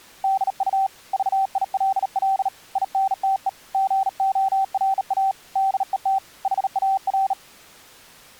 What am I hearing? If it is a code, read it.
Morse code, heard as a keyed tone, hand-sent with a bug key, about 38 wpm, 770 Hz. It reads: DU VILL INTE GORA DET HAR